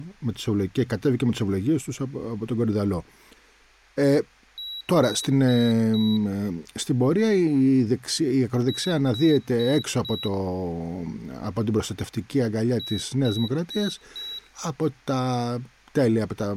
Beep code, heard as a piezo beeper, played three times, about 3900 Hz, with speech in Greek. 4 short. In AMI BIOS tables: system timer failure; in Dell tables: memory read or write failure.